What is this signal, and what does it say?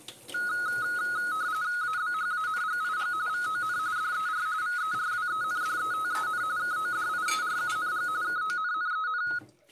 RTTY (45.45 baud, 170 Hz shift), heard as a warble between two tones, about 1360 Hz centre, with kitchen noise. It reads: ABHANGIG VON DER VERWENDETEN KODIERUNG KONNEN